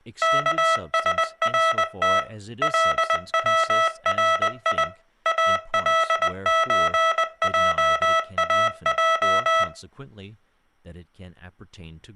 Morse code (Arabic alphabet), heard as electronic beeps, machine-sent, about 20 wpm, 650 Hz, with speech in English. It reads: كسرت لوري الزجاج